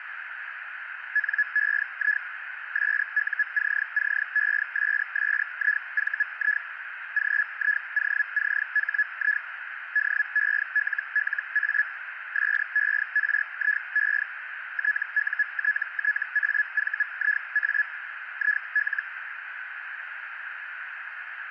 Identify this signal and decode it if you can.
Hellschreiber (Feld-Hell, 122.5 baud), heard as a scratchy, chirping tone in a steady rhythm, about 1700 Hz, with radio static and a narrow filter. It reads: NEI SUCCESSIVI GIOCHI DELLA SERIE TUTTAVIA IL